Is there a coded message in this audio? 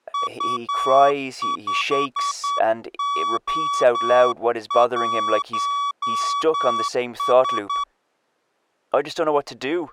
Yes: Morse code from 0.1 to 7.9 s, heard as a keyed tone, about 9 wpm, 1140 Hz, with speech in English. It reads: U5O1S